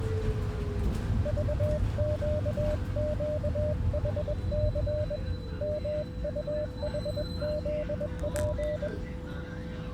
Morse code, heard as a keyed tone, hand-sent with a paddle, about 21 wpm, 600 Hz, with the noise inside a bus. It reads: VQQHC MUHZP